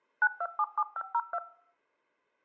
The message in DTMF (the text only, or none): 9277502